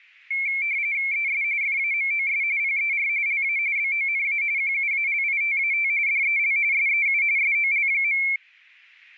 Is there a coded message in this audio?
Yes: RTTY (45.45 baud, 170 Hz shift) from 0.3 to 8.4 s, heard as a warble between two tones, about 2250 Hz centre. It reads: ES FAMOS PER LA BONA QUALITAT DEL SEU SOL.